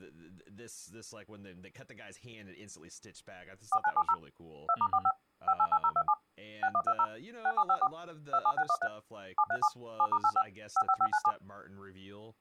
DTMF, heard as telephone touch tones, dialled by machine, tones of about 60 ms, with speech in English. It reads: 4970 2*45 588027 6120 6754 27613 737 7*85 55597